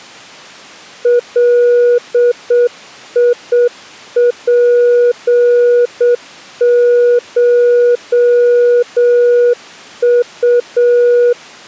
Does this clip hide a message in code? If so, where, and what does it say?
Yes: Morse code (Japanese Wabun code) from 1.0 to 11.4 s, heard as a keyed tone, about 7 wpm, 480 Hz. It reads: ガツコウ